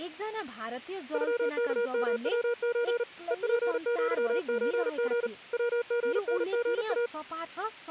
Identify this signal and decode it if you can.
Morse code (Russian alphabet), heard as a keyed tone, hand-sent with a paddle, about 38 wpm, 480 Hz, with speech in Nepali. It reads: ЮКМВЧ ЕПЪЧГ ВГНГА